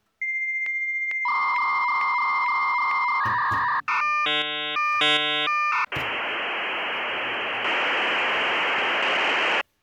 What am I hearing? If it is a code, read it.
Dial-up modem handshake (V.34 or later), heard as a whistle, warbles, then hiss, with kitchen noise.